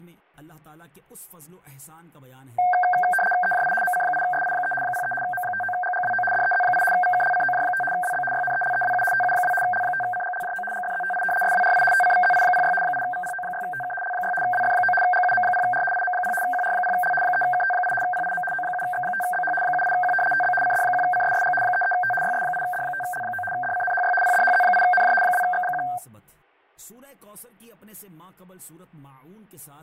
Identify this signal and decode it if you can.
RTTY (75 baud, 850 Hz shift), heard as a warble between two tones, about 1150 Hz centre, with fading. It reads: EJI MC8SI3 03 M59GGWO DEZ8 VKLCOJ5 WB YNELEWU TU2 L5CGLJO GFZTI SWRI TCVZI06 8VPO6TK L6 WF9 GUM0R IM0 QR0L 3KT8 PIM O7X5BH 78Q TB CD1CSSG 33T YS8D5L9 DCNHY PDHZ8NJ 2X1